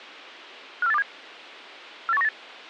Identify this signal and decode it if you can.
Five-tone selective call (EEA), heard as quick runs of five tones, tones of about 40 ms. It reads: 54827 48198